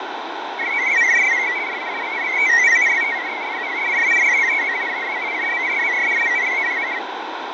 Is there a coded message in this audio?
Yes: multi-tone FSK (Olivia or MFSK type), about 500 Hz wide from 0.6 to 7.0 s, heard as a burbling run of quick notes, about 62.5 baud, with radio static and fading.